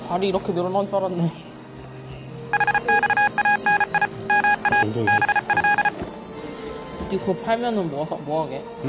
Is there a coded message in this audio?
Yes: Morse code (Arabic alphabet) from 2.5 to 5.9 s, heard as electronic beeps, machine-sent, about 34 wpm, 820 Hz, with the noise of a cafe. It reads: حصاني ما به